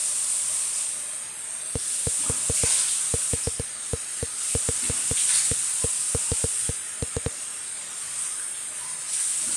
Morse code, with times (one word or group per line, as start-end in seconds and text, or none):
none